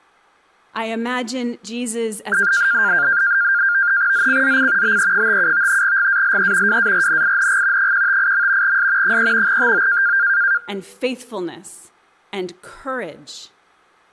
NAVTEX (SITOR-B), 100 baud, 170 Hz shift, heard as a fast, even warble, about 1500 Hz centre. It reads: ZCZC BE57 GALE WARNING 158. S 3 TO